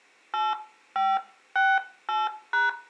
DTMF, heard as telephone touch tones, dialled by hand, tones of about 200 ms, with room echo. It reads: 8568#